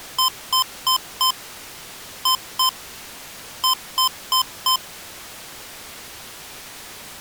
Beep code, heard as beeps from a small speaker, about 1030 Hz. 4-2-4. In Phoenix BIOS tables: unexpected interrupt in protected mode.